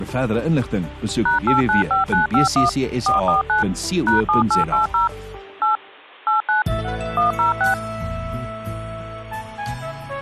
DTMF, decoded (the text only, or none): #895951 449 #7880 8 89 106